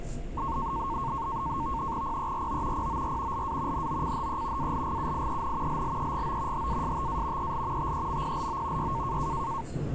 NAVTEX (SITOR-B), 100 baud, 170 Hz shift, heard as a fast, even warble, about 1000 Hz centre, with the noise inside a subway train. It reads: PERO POR LA NOCHE ALGUIEN LLEGO HASTA EL TEMPLO Y